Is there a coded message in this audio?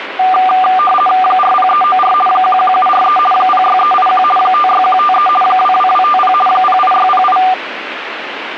Yes: RTTY (50 baud, 450 Hz shift) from 0.2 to 7.5 s, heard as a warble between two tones, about 970 Hz centre, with radio static. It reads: 40394 11743 06381 56153 22250 08608